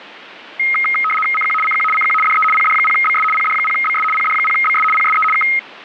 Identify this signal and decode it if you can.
RTTY (75 baud, 850 Hz shift), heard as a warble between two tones, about 1700 Hz centre. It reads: CQ CQ CQ DE PD0BS PD0BS PD0BS PSE K